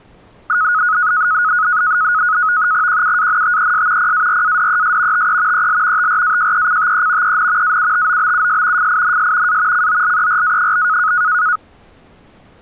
NAVTEX (SITOR-B), 100 baud, 170 Hz shift, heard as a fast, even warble, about 1360 Hz centre. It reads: QUANTES PARADES TE EL TRAJECTE EN AUTOBUS FINS A COLERA?